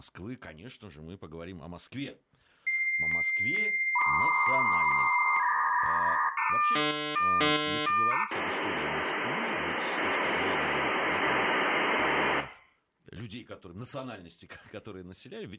Dial-up modem handshake (V.34 or later), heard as a whistle, warbles, then hiss, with room echo and speech in Russian.